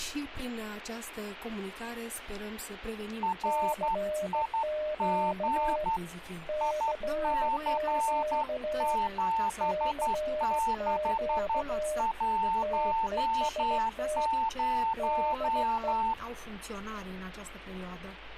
Morse code, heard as two keyed tones. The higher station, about 11 wpm, 900 Hz: RIG IC7610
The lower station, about 16 wpm, 610 Hz: CQ CQ CQ TEST DE